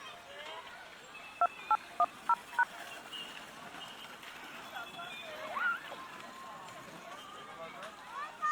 DTMF, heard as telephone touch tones, dialled by machine, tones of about 50 ms, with the noise of a park. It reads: 2810#